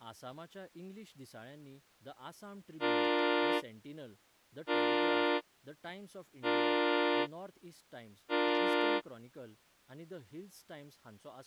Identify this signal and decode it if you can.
Train horn signal, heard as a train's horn, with speech in Goan Konkani. 4 short. On North American railways: a request for a signal to be given or repeated.